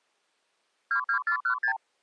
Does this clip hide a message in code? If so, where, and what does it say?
Yes: multi-frequency trunk signalling (R2, with the far end's replies) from 0.9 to 1.8 s, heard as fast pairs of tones, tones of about 90 ms. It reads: 22416